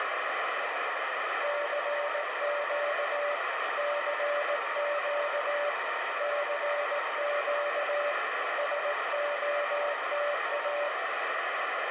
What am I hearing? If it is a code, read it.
Morse code, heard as two keyed tones, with heavy radio static. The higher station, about 14 wpm, 920 Hz: SQ4QME 5NN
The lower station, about 18 wpm, 580 Hz: CQ CQ CQ SOTA